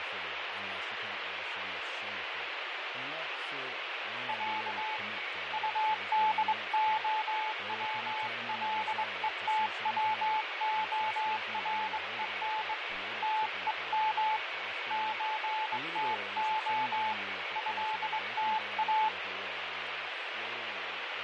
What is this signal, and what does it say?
Morse code (Russian alphabet), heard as a keyed tone, hand-sent with a straight key, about 22 wpm, 870 Hz, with radio static, fading, a weaker station near 2240 Hz and speech in English. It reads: Я УДОВЛЕТВОРЕН ТЕМ ЧТО ЭТА